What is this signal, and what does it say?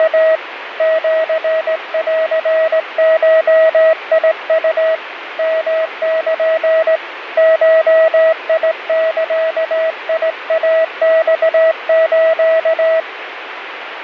Morse code (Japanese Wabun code), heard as a keyed tone, hand-sent with a straight key, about 18 wpm, 640 Hz, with radio static. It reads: … シンゴウ ヨル ゴザイマス